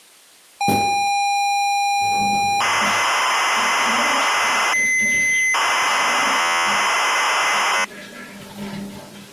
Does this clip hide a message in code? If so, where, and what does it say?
Yes: ZX Spectrum tape loading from 0.6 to 7.8 s, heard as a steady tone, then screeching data, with the noise of a restroom.